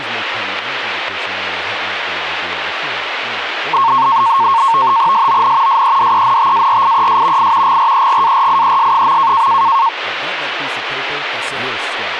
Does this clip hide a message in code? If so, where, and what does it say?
Yes: NAVTEX (SITOR-B), 100 baud, 170 Hz shift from 3.7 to 9.9 s, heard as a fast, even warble, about 1000 Hz centre, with radio static and speech in English. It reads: SON SEDENTARIES I GREGARIES.